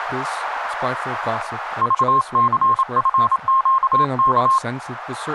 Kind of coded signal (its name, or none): Morse code